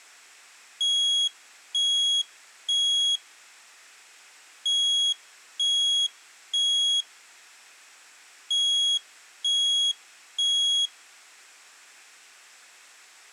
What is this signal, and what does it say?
Alarm pattern, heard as an alarm's beeps, played three times, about 3300 Hz. Temporal three. Smoke or fire, evacuate.